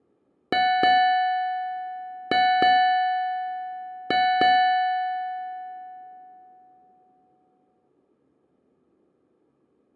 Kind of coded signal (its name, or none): ship's bell